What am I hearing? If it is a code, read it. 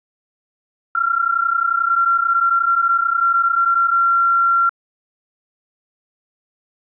PSK31 (31.25 baud), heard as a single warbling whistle, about 1370 Hz.